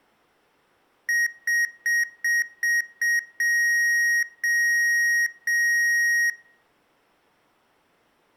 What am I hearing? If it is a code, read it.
Beep code, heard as beeps from a small speaker, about 1900 Hz, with room echo. 6 short, 3 long.